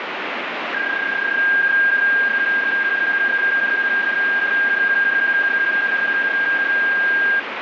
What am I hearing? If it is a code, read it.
PSK31 (31.25 baud), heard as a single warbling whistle, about 1600 Hz, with radio static.